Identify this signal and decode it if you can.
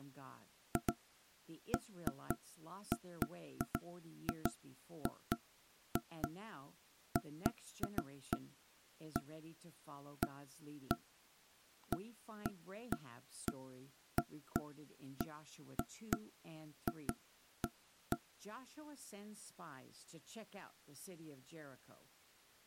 Irregular knocks on wood, with speech in English. There is no code.